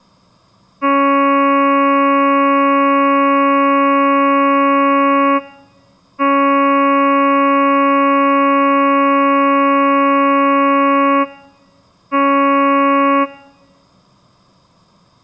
Ship horn signal, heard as a ship's horn, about 280 Hz. 2 long, 1 short. At sea: I intend to overtake on your starboard side.